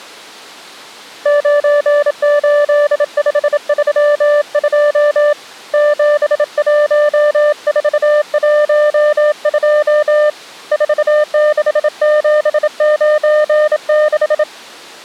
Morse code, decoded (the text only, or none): 98532 71412 46796